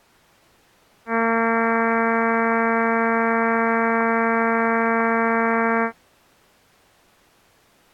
Ship horn signal, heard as a ship's horn, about 230 Hz. 1 long. At sea: a vessel nearing a blind bend, or under power and making way in fog.